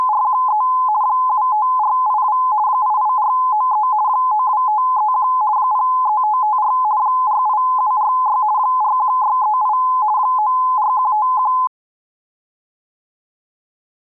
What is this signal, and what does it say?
RTTY (50 baud, 170 Hz shift), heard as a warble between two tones, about 940 Hz centre. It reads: … 75482 88493 92531 03554 48746 41638 94151